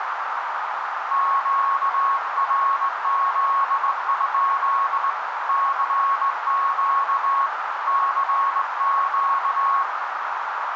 Morse code, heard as a keyed tone, hand-sent with a straight key, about 19 wpm, 1100 Hz, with heavy radio static and a narrow filter. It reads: QRZ? CQ CQ